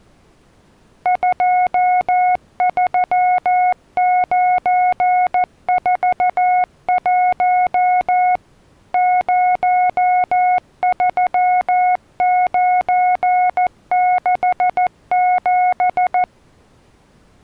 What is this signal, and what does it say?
Morse code, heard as a keyed tone, machine-sent, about 14 wpm, 730 Hz. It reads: 23941 03967